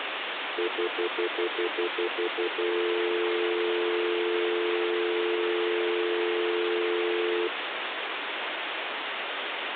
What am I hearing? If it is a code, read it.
Telephone call progress tone (North American plan), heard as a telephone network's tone, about 350, 440 Hz, 0.1 s on and 0.1 s off, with phone line noise. Stutter dial tone.